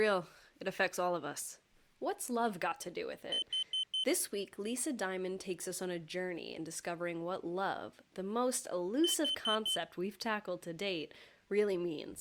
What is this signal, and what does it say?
Alarm pattern, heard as an alarm's beeps, played twice, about 3050 Hz, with speech in English. Temporal four. Carbon monoxide.